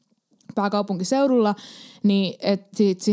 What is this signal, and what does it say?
Speech in Finnish. There is no code.